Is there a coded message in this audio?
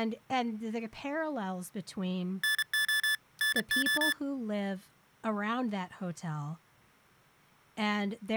Yes: Morse code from 2.4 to 4.2 s, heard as electronic beeps, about 32 wpm, 1750 Hz, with speech in English. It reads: NO NO